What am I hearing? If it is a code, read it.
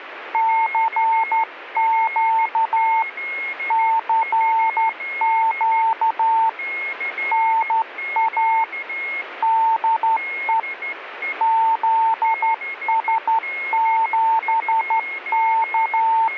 Morse code, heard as a keyed tone, hand-sent with a straight key, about 12 wpm, 900 Hz, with a weaker station near 2160 Hz. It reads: CQ CQ NA DE …